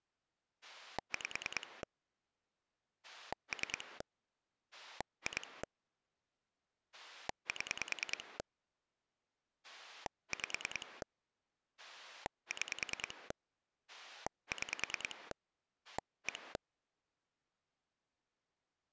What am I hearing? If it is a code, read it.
Pulse dialling, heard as a rotary dial, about 9 pulses a second. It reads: 5 3 2 7 5 6 6 1